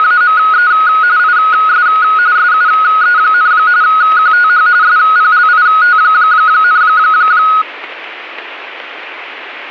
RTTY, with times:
0.0-0.7 …
1.2-1.9 IS
2.4-3.5 SUE,
3.8-4.7 QTH
4.8-6.8 SPLIT,

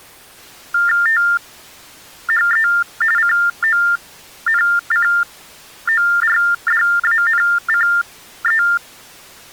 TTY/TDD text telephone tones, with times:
1.1-2.7 THE
3.2-8.6 CONCORDANCE

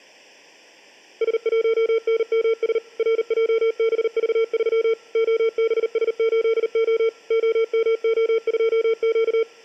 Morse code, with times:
1.2-2.8 S1NMS
3.0-4.9 RJBV3
5.2-7.1 OBS8O
7.3-9.4 OMO2Q

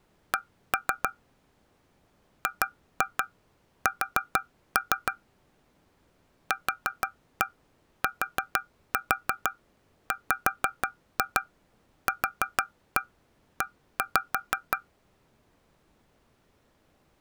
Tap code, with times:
0.3-1.1 C
2.5-5.1 GS
6.5-14.8 QTWQE

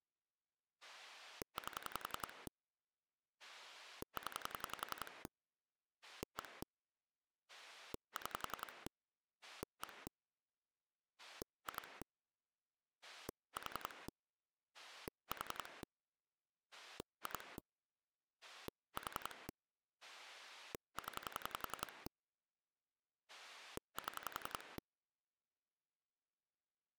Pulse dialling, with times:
0.8-2.5 8
3.4-5.3 0
6.0-6.6 1
7.5-8.9 6
9.4-10.1 1
11.2-12.0 2
13.0-14.1 4
14.7-15.8 4
16.7-17.6 2
18.4-19.5 4
20.0-22.1 0
23.3-24.8 7

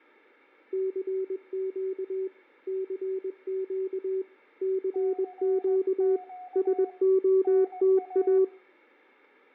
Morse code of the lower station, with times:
0.7-2.3 CQ
2.7-4.2 CQ
4.6-6.2 CQ
6.6-8.4 SOTA

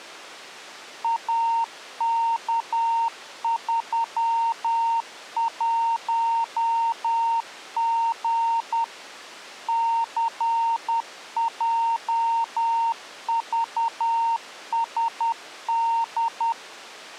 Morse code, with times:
1.0-8.8 AK31G
9.7-16.5 CJVSD

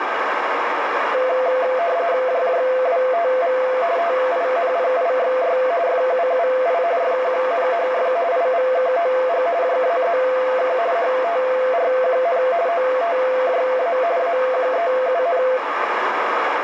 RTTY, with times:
2.3-3.6 JJWTV
4.0-5.6 TINPIXY
5.9-6.8 FUUI
7.0-8.1 FQNHF
8.3-9.5 IVKOG
9.6-10.8 JAZK
11.0-12.4 HTRQN
12.7-14.0 OTJA
14.2-15.4 AQEUN

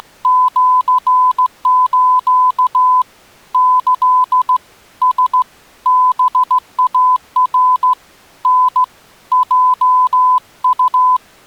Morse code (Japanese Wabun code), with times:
0.0-3.0 …
3.5-4.6 キ
5.0-5.4 ラ
5.9-7.9 ハイナ
8.5-8.8 タ
9.3-11.2 ヲウ

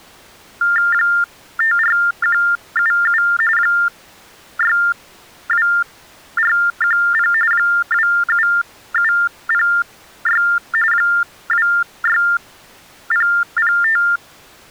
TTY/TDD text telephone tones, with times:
0.9-3.2 54177
3.6-7.3 62410
7.5-10.4 27706
10.9-14.0 26005

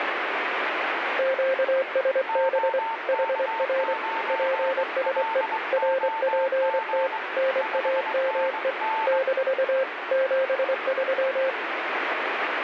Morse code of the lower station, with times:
1.2-2.8 QSB
3.1-3.9 HR
4.3-5.4 PSE
5.7-7.1 RPT
7.4-8.7 NAME
9.1-9.8 -
10.1-11.5 73

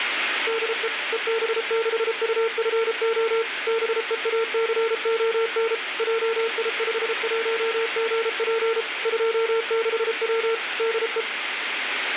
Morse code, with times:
0.5-0.9 DE
1.1-3.4 EB6UFO
3.7-5.7 BEACON
6.0-8.8 JI51GP
9.1-10.5 26W
10.8-11.2 DE

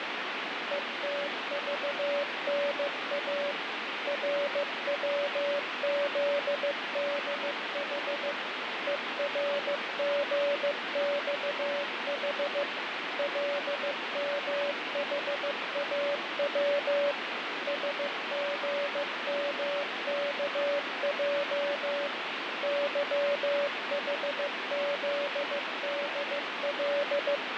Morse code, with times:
0.7-3.5 ETVNA
4.1-8.3 RWZDH
8.9-12.6 ERGXH
13.2-17.1 LMHAW
17.7-22.1 SGMKJ
22.6-27.4 YHZDL

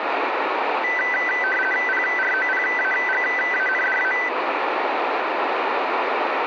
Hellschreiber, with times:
none

